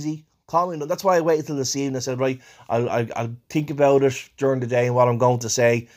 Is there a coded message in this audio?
No, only speech in English.